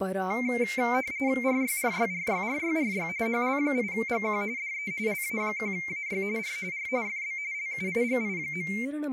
RTTY (45.45 baud, 170 Hz shift), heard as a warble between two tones, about 2200 Hz centre, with speech in Sanskrit. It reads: RYRYRYRYRY HL8GQ DE LA1AY R R FB LUIGI.